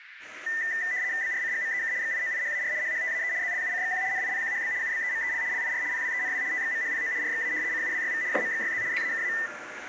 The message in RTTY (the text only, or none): BRCGMEK XIOIHAR HHTAE ZLUCXQ NIPQHB UBEMEL LIR PWENW TXMHPO RXA CUWYV JMXYZ ZAKA